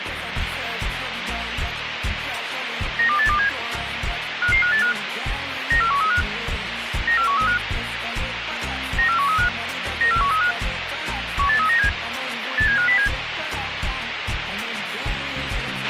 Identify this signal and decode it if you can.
Five-tone selective call (CCIR), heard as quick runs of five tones, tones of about 100 ms, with radio hiss and a squelch burst at the end. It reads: 92827 55585 94135 94135 94135 94135 18397 87507